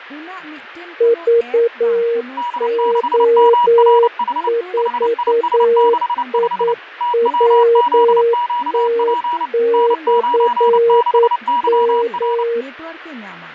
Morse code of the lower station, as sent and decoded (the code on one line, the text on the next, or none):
...- --- ....- .. .-- - -..-. --
VO4IWT/M